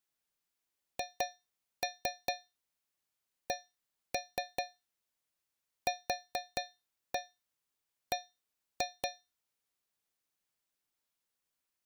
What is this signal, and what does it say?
Tap code, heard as taps on a metal pipe, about 4 knocks a second. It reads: HCQB